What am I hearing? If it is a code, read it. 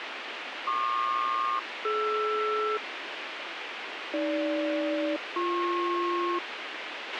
Aircraft SELCAL, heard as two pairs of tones, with radio hiss and a squelch burst at the end. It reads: PQ-DR AG-BP